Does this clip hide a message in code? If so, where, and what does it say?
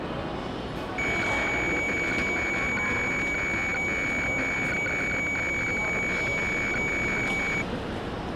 Yes: weather fax (radiofax), 120 lines a minute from 1.0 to 7.6 s, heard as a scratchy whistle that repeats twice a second, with the noise of a crowd indoors.